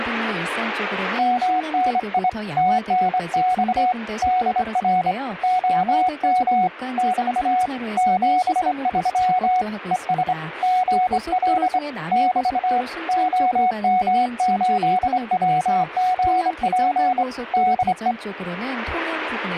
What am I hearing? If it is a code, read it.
Morse code, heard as a keyed tone, hand-sent with a straight key, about 25 wpm, 740 Hz, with radio static and speech in Korean. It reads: MNI TNX DR OM <BT> 73 ES GL <BT> OM8WGP DE